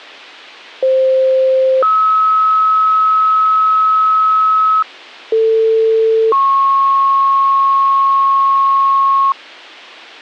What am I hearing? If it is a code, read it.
Two-tone page, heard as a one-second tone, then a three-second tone, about 520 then 1290 Hz, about 450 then 1090 Hz.